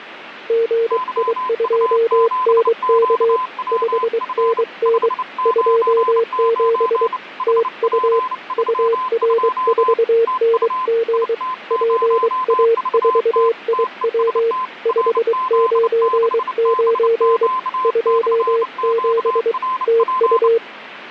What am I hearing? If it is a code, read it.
Morse code, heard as two keyed tones, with radio static. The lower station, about 23 wpm, 460 Hz: GI2NK 5NN 27 TU UR4NG PA4IW 599 27 TU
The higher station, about 29 wpm, 1020 Hz: YU7QWF 599 HP32 TU IT0VT TEST RZ6BQ/QRP